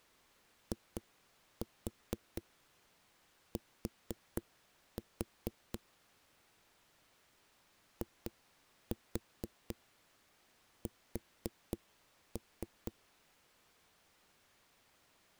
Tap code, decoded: IT IS

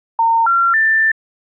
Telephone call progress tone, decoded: special information tone

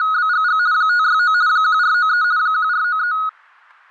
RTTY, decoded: … 569 1493 1493

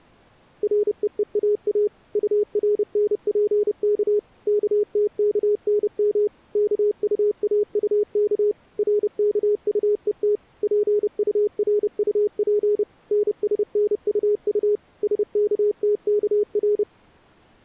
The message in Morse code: REEAA URNPK KTKNM KUAUK RKUET PURUP NSNUU SKTKR

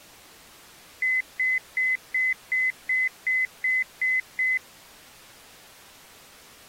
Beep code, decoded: 10 short

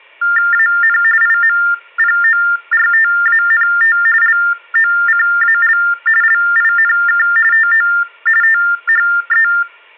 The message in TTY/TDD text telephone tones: AN IMPORTANT LOCAL LINK TO THE

